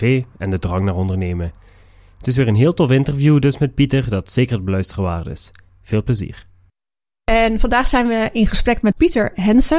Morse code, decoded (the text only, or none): none